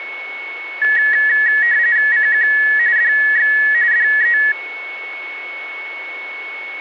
RTTY (45.45 baud, 170 Hz shift), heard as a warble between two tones, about 1800 Hz centre, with a steady whistle near 2210 Hz. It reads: CQ DX DE